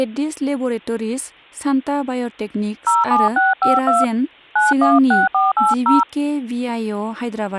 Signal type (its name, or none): DTMF